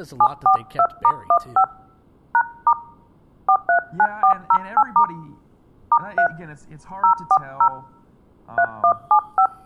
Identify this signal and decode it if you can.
DTMF, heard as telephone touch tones, dialled by hand, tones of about 80 ms, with speech in English. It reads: 742*15 #* 439408* *3 040 3175